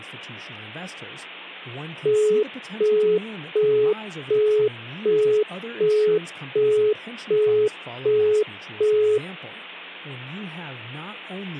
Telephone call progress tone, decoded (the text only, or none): busy tone